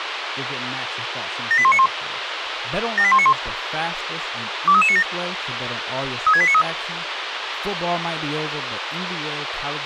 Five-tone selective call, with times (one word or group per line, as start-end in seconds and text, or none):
1.5-1.9 78191
3.0-3.3 78191
4.7-5.0 23397
6.3-6.6 36893